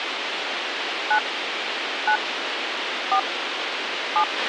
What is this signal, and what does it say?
DTMF, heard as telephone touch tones, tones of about 80 ms, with radio hiss and a squelch burst at the end. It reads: 9 9 4 7